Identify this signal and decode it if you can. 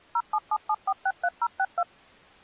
DTMF, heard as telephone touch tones, dialled by machine, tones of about 60 ms. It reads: 0777463062